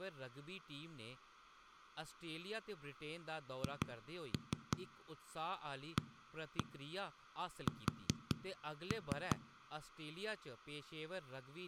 Tap code, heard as knocks on a wall, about 5 knocks a second, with speech in Dogri. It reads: HAS